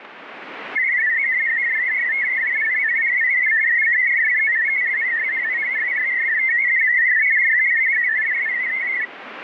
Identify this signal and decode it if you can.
Multi-tone FSK (Olivia or MFSK type), about 500 Hz wide, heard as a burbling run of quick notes, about 62.5 baud, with radio static.